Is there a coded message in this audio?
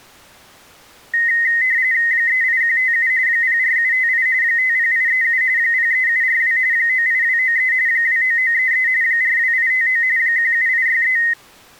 Yes: RTTY (45.45 baud, 170 Hz shift) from 1.1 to 11.3 s, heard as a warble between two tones, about 1950 Hz centre. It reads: 38157 04758 50837 03742 98293 29933 42859 17863